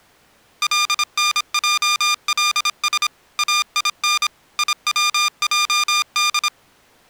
Morse code (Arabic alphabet), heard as electronic beeps, machine-sent, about 26 wpm, 1200 Hz. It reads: لنجلس اين يوجد